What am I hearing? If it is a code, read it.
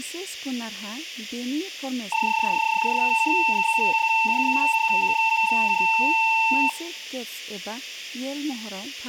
PSK31 (31.25 baud), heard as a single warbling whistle, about 900 Hz, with room echo and speech in Bodo.